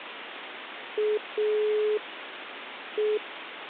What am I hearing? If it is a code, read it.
Telephone call progress tone (pulsed, as in Italy), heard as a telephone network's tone, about 420 Hz, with phone line noise. Dial tone.